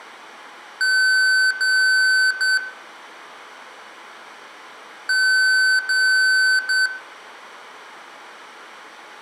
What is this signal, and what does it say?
Beep code, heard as beeps from a small speaker, played twice, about 1500 Hz, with room echo. 2 long, 1 short.